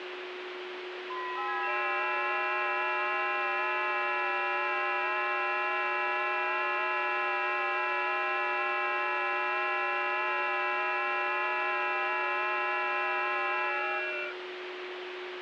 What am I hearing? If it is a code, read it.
FT8 (several signals at once), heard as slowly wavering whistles, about 6.25 baud, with radio static and a steady whistle near 360 Hz.